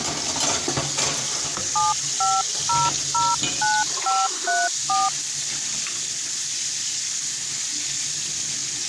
DTMF, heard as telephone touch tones, dialled by hand, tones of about 210 ms, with kitchen noise. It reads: 75009534